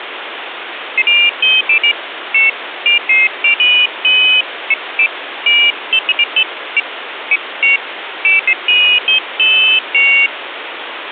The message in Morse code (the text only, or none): none